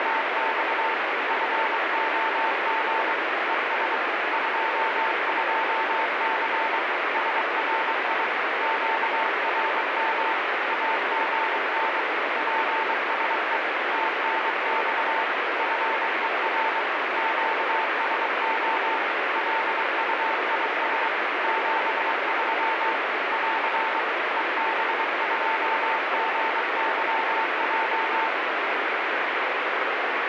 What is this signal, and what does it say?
Morse code, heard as a keyed tone, machine-sent, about 23 wpm, 890 Hz, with heavy radio static. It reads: … FOG ES 22C SRI QRM AGN PSE TNX FER QSO LUIS 73 <AR> EB2GYJ